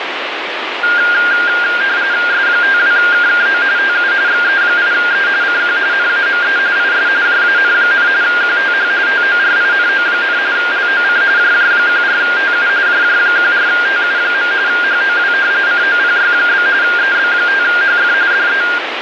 RTTY (45.45 baud, 170 Hz shift), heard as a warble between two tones, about 1500 Hz centre, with radio static. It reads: S52KKO TU XE8E CQ NAME IS JAN, QTH TORINO, LOC JJ14TU JJ14TU. HOW COPY? EB5HF DE